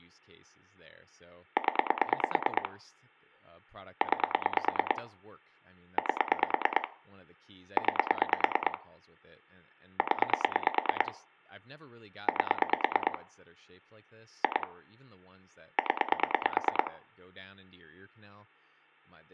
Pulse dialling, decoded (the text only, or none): 0 9 8 9 0 8 2 0